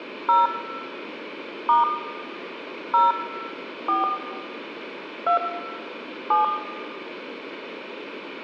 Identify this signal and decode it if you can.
DTMF, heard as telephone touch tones, dialled by hand, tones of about 120 ms, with room echo. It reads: 0 * 0 4 2 7